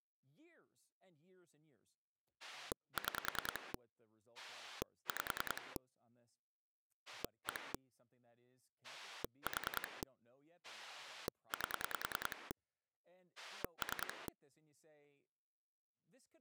Pulse dialling, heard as a rotary dial, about 10 pulses a second, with speech in English. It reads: 6 5 1 4 8 3